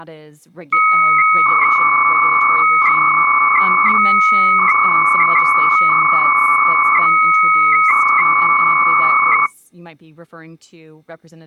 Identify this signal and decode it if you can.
300-baud modem data (Bell 103 tones), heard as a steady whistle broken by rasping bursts, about 300 baud, 200 Hz shift, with speech in English.